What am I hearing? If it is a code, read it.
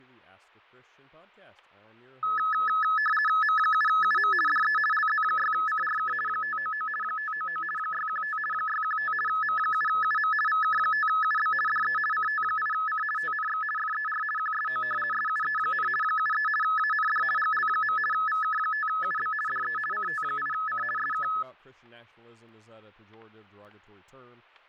RTTY (50 baud, 450 Hz shift), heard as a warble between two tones, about 1500 Hz centre, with fading, static crashes and speech in English. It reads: M7UM DE LZ6CRK 599 599 615 615 M7UM VK5UB DE CT8C TNX FER QSO SUE, 73 AND GL. VK5UB DE CT8C SK